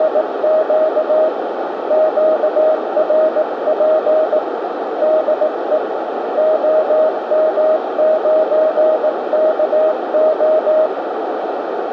Morse code, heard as a keyed tone, hand-sent with a paddle, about 18 wpm, 630 Hz, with radio static and a narrow filter. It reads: … QRP DE OM9KO